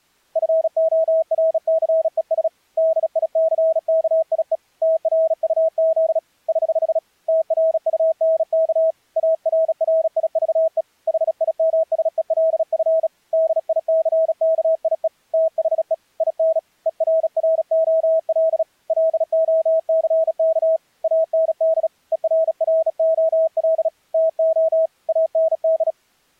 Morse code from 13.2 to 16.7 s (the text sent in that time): DICKIE THE IN